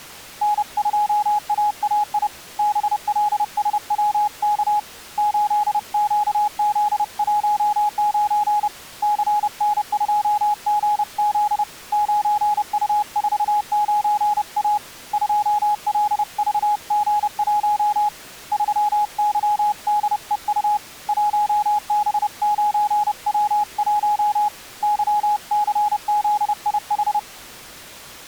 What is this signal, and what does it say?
Morse code, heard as a keyed tone, hand-sent with a paddle, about 30 wpm, 840 Hz. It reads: N2AAI BLSWK 8QZ19 CN2GZ 9U49A 2LVG1 3YDEU 1B9W1 YCZIH